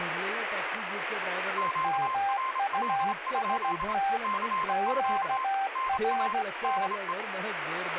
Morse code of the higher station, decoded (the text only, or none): QRL? CQ NA DE